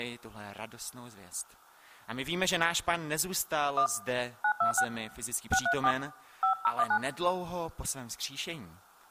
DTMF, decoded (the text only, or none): 1 926 634 5019